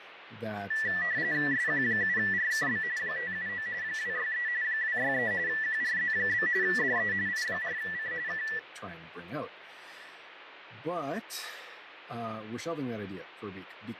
RTTY (45.45 baud, 170 Hz shift), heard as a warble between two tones, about 1850 Hz centre, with radio static. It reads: SQ7RKB 579 263 263 QRZ? DE I4C K